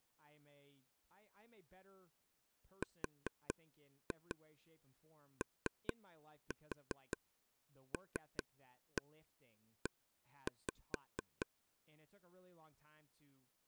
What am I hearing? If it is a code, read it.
Tap code, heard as taps on a table, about 4 knocks a second, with speech in English. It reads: ROLE